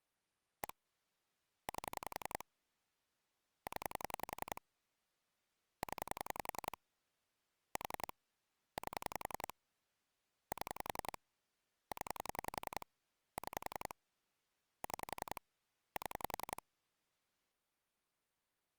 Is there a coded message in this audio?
Yes: pulse dialling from 0.6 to 16.6 s, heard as clicks on a phone line, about 11 pulses a second. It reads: 1 8 0 0 4 8 7 0 6 6 7